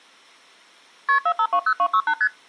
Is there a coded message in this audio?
Yes: multi-frequency trunk signalling (R1, as on North American trunks) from 1.1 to 2.3 s, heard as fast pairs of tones, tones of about 70 ms. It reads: KP 4520268 ST